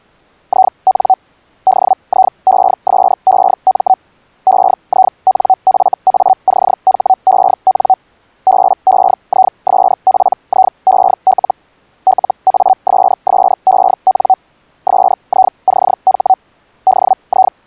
Hellschreiber (Feld-Hell, 122.5 baud), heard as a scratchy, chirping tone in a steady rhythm, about 760 Hz. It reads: IN DIESEM EINFACHEN BEISPIEL LASSEN SICH …